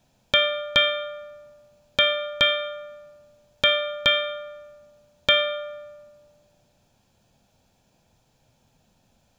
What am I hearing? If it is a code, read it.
Ship's bell, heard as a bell, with room echo. 7. Seven half-hours of the watch have passed.